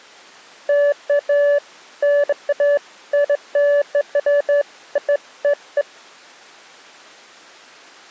Beeps of irregular length. There is no code.